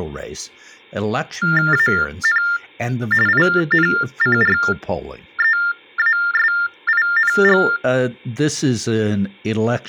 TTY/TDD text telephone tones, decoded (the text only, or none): AN INCREASING